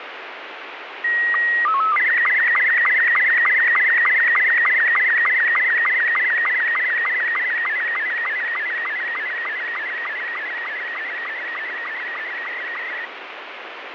SSTV (slow-scan television), Robot 72, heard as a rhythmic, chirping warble, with heavy radio static and fading.